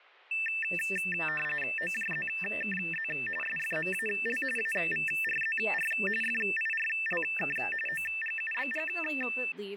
RTTY (45.45 baud, 850 Hz shift), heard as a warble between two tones, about 2200 Hz centre, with speech in English. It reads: OJZKZ SFMAL AVRZR FIRLK OGUBG